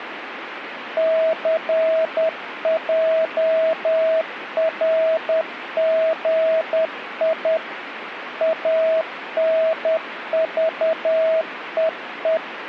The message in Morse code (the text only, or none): CJRGI ANVEE